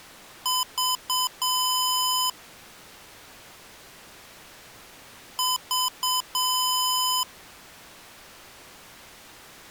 Beep code, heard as beeps from a small speaker, played twice, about 1010 Hz. 3 short, 1 long.